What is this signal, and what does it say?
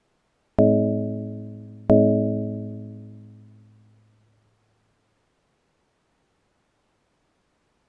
Clock strike, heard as a bell. 2. Two o'clock.